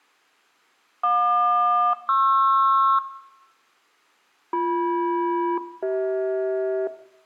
Aircraft SELCAL, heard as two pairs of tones, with room echo. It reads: JQ-PR BM-CH